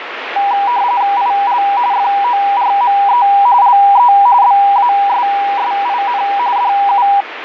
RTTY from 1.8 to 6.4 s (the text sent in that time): FORME LE BASSIN